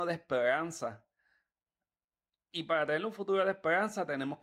Speech in Spanish. There is no code.